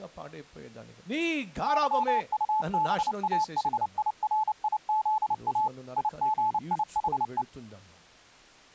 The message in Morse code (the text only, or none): YUBAHIRIZA IGIHE